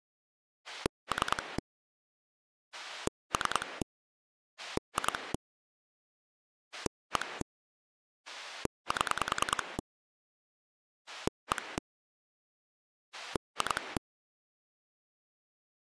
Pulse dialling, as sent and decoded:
3 / 3 / 2 / 1 / 7 / 1 / 2
3 3 2 1 7 1 2

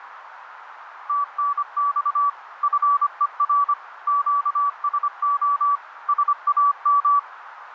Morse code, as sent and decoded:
- -. -..- / ..-. . .-. / --.- ... --- / ... .- --
TNX FER QSO SAM

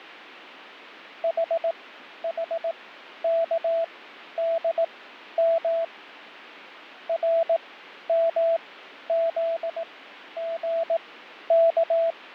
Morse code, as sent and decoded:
.... .... -.- -.. -- / .-. -- --.. --. -.-
HHKDM RMZGK

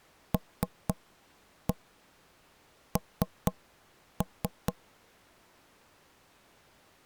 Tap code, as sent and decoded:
3-1 3-3
LN

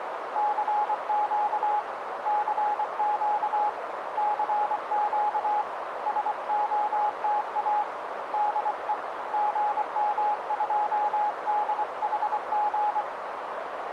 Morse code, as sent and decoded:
-.-. --.- / -.-. --.- / -.-. --.- / ... --- - .- / -.. . / --. -- ..--- -.. .... --.
CQ CQ CQ SOTA DE GM2DHG

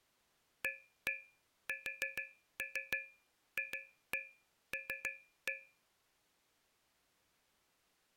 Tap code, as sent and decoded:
1-1 4-3 2-1 3-1
ASFL

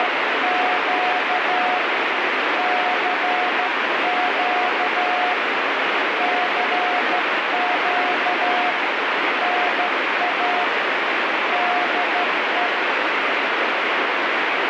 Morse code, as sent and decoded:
… / -.-. --.- / -.-. --.- / -. .- / -.. .
… CQ CQ NA DE

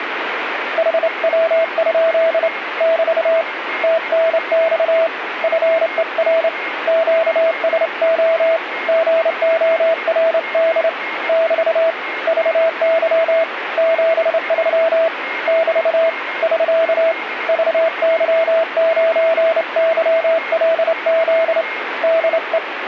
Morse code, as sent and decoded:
.... .-- ..--.. / -...- / - -. -..- / ..-. . .-. / --.- ... --- / --. --- .-. -.. / -...- / ...- -.-- / --... ...-- / -...- / ...-.- / ...- -.-- ----. -.-- .-.. --.. / -.. .
HW? <BT> TNX FER QSO GORD <BT> VY 73 <BT> <SK> VY9YLZ DE

